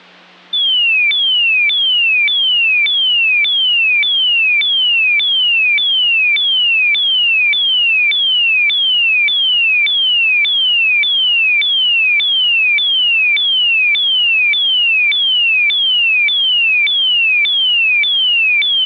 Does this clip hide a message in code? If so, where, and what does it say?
No, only a tone that sweeps in pitch again and again, with hum.